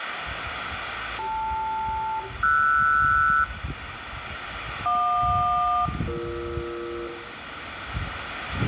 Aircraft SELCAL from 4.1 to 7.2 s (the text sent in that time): JQ-BE